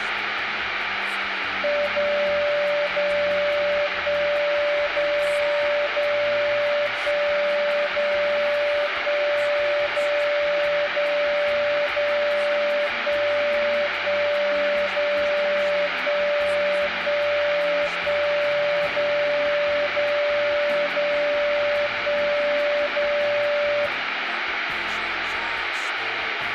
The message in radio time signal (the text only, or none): 0 0 1 0 0 1 0 1 0 0 0 1 1 0 1 1 1 0 0 0 1 0